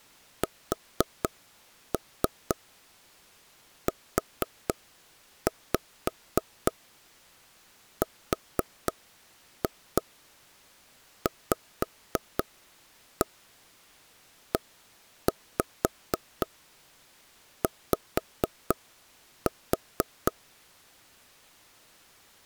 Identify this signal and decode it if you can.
Tap code, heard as taps on a table, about 4 knocks a second. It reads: SURVEY